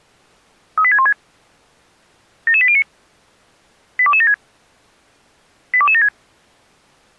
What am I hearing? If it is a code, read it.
Five-tone selective call (ZVEI), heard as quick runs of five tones, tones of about 70 ms. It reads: 38616 77809 82276 82276